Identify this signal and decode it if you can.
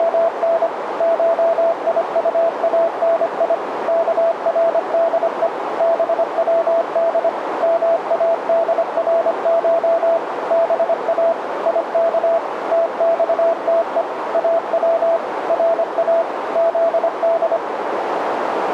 Morse code (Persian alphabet), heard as a keyed tone, machine-sent, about 25 wpm, 670 Hz, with radio static and a narrow filter. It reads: … شیطانی کرده بود مادرش با یک تخته او را زد